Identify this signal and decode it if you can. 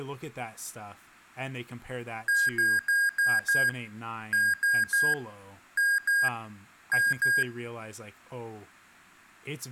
Beep code, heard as beeps from a small speaker, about 1600 Hz, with speech in English. 5-3-2-2.